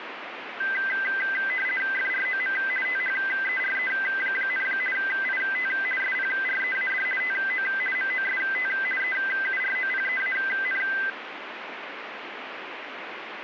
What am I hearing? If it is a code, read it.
RTTY (50 baud, 450 Hz shift), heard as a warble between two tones, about 1800 Hz centre, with radio static. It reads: FROM THERE, IT SPREAD TO MOST EUROPEAN